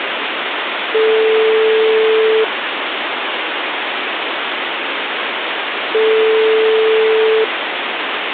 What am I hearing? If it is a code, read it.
Telephone call progress tone (single-tone plan, as in most of Europe), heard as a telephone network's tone, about 440 Hz, 1.5 s on and 3.5 s off, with phone line noise. Ringback tone.